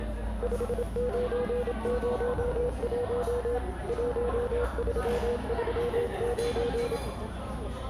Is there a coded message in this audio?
Yes: Morse code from 0.4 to 7.0 s, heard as a keyed tone, machine-sent, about 27 wpm, 480 Hz, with the noise of a cafe. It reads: 5901 1339